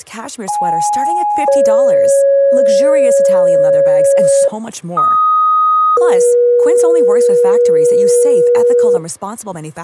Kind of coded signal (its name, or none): two-tone page